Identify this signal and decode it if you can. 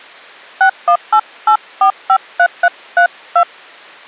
DTMF, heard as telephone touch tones, dialled by hand, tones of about 80 ms. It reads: 6188453332